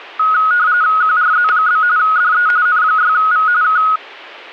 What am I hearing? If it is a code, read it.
RTTY (45.45 baud, 170 Hz shift), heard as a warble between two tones, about 1360 Hz centre, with static crashes. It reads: QRZ? DE N6V K